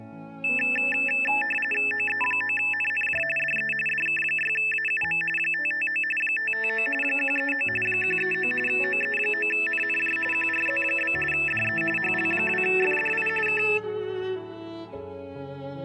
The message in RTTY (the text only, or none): OE9NNJ DE DK6AUM 559 559 139 139 OE9NNJ QRZ? DE HL2FDI K